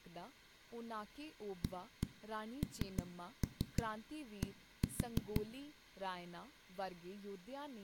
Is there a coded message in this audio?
Yes: tap code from 1.6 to 5.4 s, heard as knocks on a wall, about 6 knocks a second, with room echo and speech in Punjabi. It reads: AND